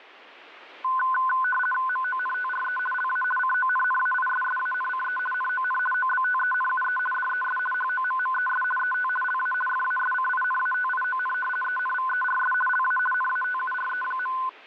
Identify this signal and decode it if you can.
RTTY (50 baud, 450 Hz shift), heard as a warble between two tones, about 1260 Hz centre. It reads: MONTRE LA CONNAISSANCE NON OBTENUE DES HOMMES ET LA FASCINATION ENVERS LA NATURE.